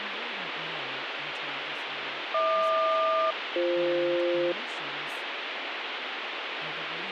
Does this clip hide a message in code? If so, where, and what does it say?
Yes: aircraft SELCAL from 2.3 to 4.5 s, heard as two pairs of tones, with radio static and speech in English. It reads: HQ-BF